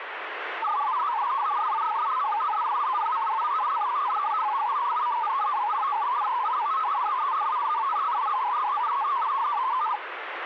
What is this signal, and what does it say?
Multi-tone FSK (Olivia or MFSK type), about 500 Hz wide, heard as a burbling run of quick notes, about 62.5 baud, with radio static.